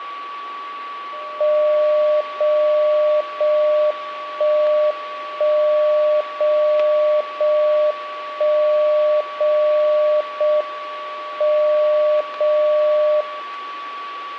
Radio time signal (JJY), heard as a tone whose level steps once a second, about 600 Hz, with a steady whistle near 1140 Hz. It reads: 0 0 1 1 0 0 1 0 0 M 0 0